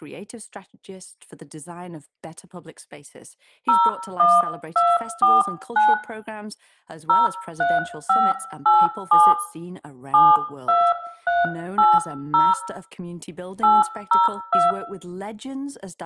DTMF, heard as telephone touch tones, dialled by hand, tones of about 210 ms, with room echo and speech in English. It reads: 01249 03587 72380 802